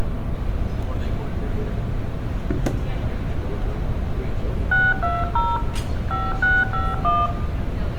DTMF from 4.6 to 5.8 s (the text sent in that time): 620